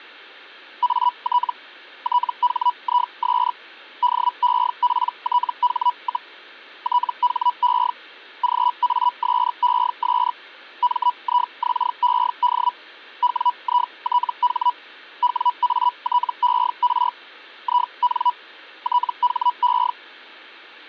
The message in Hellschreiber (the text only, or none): AT THIS DEPTH, THE GASES MIXED WITH WATER IN THE